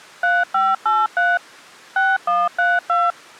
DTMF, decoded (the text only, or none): 3583 6132